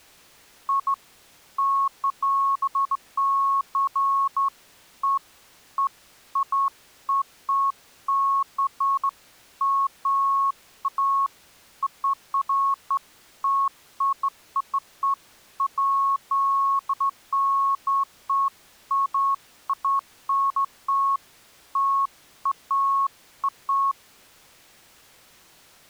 Beeps of irregular length. There is no code.